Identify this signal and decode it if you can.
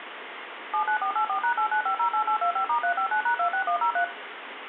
DTMF, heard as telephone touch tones, dialled by machine, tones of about 90 ms, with phone line noise and room echo. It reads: 79484#89508825*359#26103